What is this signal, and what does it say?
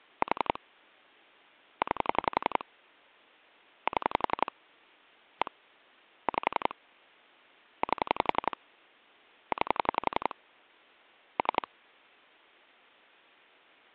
Pulse dialling, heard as clicks on a phone line, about 11 pulses a second. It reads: 4 9 7 1 5 8 9 3